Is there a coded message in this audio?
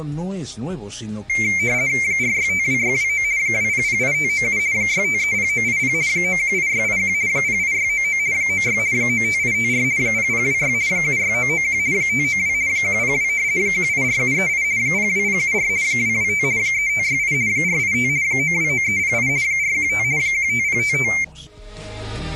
Yes: RTTY (50 baud, 170 Hz shift) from 1.3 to 21.2 s, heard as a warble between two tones, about 2200 Hz centre. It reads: 4652629 2008597 6530980 918681 08699 96 95854 0026 76991 592 102 184738 02074 225 3568 485 929308 415 15055